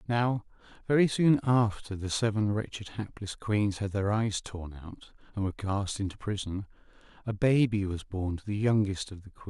Speech in English. There is no code.